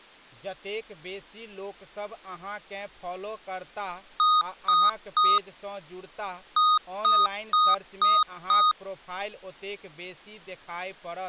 Beep code, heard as beeps from a small speaker, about 1240 Hz, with speech in Maithili. 3-5.